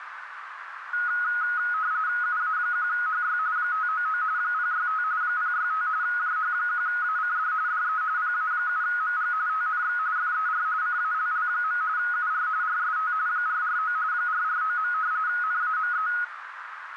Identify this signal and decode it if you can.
RTTY (45.45 baud, 170 Hz shift), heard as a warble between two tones, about 1360 Hz centre, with radio static and a narrow filter. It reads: UA1HY 599 065 065 JH1ACD DE PA7MG TNX FER CALL. UR RST 449 449. NAME